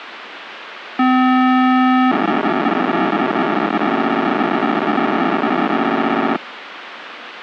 POCSAG pager data (512 baud), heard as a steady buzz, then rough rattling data, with radio hiss.